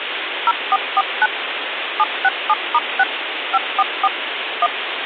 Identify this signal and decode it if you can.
DTMF, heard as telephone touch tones, dialled by machine, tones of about 40 ms, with phone line noise. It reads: 0449 767*6 544 1